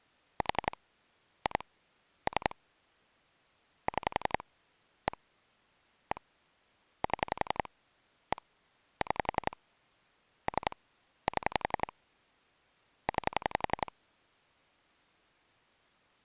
Pulse dialling, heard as clicks on a phone line, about 11 pulses a second. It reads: 4 2 3 6 1 1 7 1 6 3 7 9